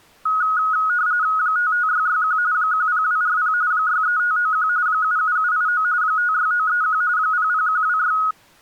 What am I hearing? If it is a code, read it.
RTTY (45.45 baud, 170 Hz shift), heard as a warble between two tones, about 1360 Hz centre. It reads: 55661 10240 63591 77789 56931 00126